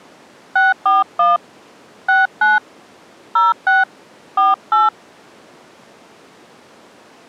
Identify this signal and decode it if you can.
DTMF, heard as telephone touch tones, dialled by hand, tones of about 170 ms. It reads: 641 69 06 48